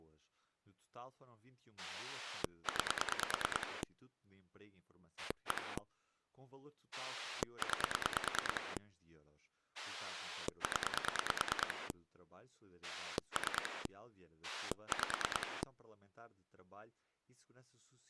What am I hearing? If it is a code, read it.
Pulse dialling, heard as a rotary dial, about 9 pulses a second, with speech in Portuguese. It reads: 9 1 9 0 3 5